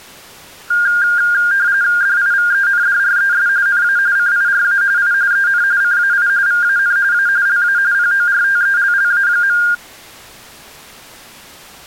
RTTY (45.45 baud, 170 Hz shift), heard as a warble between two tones, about 1500 Hz centre. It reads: DIVENDRES NA CIRA I EN CAI VAN A LA PORTELLA.